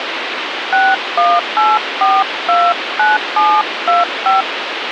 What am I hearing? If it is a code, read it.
DTMF, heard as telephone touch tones, dialled by hand, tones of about 200 ms, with phone line noise. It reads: 618429725